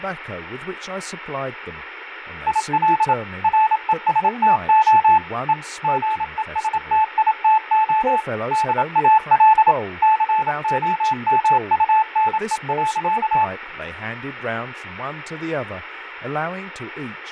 Morse code, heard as a keyed tone, machine-sent, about 27 wpm, 870 Hz, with radio static, fading and speech in English. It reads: IL RESTO E GESTITO DAL COMUNE.